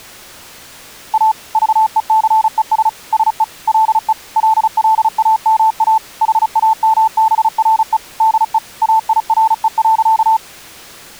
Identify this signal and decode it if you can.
Morse code, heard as a keyed tone, machine-sent, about 35 wpm, 880 Hz. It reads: A VECES SE LE LLAMA HAMBRE DE AIRE.